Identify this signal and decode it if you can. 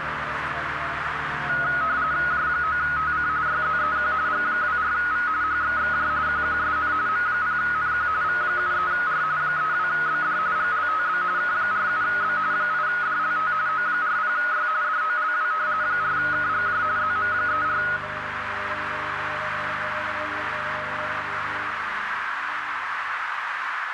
RTTY (45.45 baud, 170 Hz shift), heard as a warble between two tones, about 1360 Hz centre, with radio static and a narrow filter. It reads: J9TC YZEQ G24V HXXJ QQSN M0NQ V73R 32BD GLTB K47B 8DLT O40Y DOLW 4KGJ ZM34